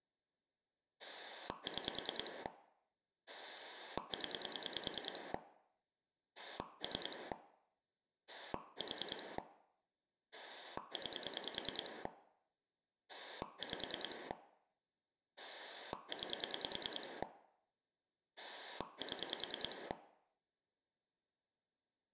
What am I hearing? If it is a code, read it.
Pulse dialling, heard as a rotary dial, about 10 pulses a second. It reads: 6 0 3 4 9 5 9 7